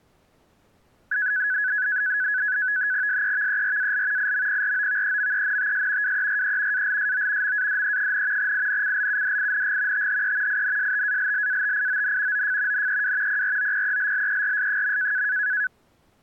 NAVTEX (SITOR-B), 100 baud, 170 Hz shift, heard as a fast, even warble, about 1600 Hz centre. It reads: SEVERAL IMPROVEMENTS WERE ALSO MADE, INCLUDING THE INSTALLATION OF NEW PROPELLERS.